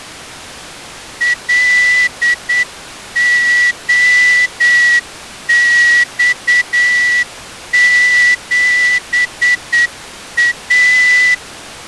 Morse code, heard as a whistle, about 8 wpm. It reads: LOX7A